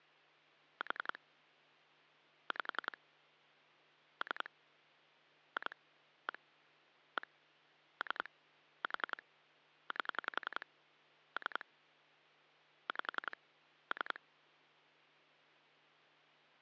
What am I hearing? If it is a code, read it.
Pulse dialling, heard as clicks on a phone line, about 11 pulses a second, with hum. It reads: 4 5 3 2 1 1 3 4 8 3 5 3